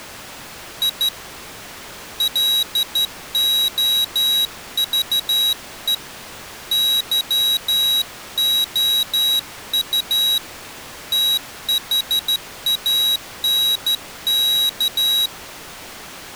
Morse code, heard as a high beeper, hand-sent with a straight key, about 13 wpm, 3850 Hz. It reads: I LOVE YOU THANK